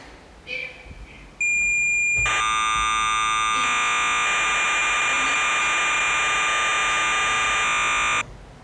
Cassette data (Kansas City type), 1200 baud, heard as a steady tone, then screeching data, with the noise inside a lift.